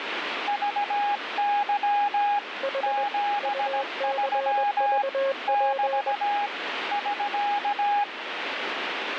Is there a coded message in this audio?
Yes: Morse code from 0.4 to 8.1 s, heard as two keyed tones, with radio static. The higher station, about 17 wpm, 820 Hz: VY 73 <BT> <SK>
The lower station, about 21 wpm, 540 Hz: H UCVP